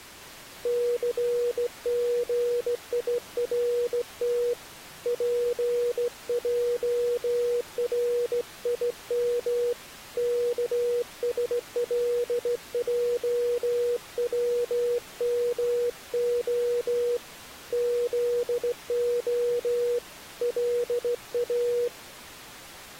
Morse code (Hebrew alphabet), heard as a keyed tone, hand-sent with a straight key, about 16 wpm, 480 Hz. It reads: סגירת פערים כשלעצמה זה לא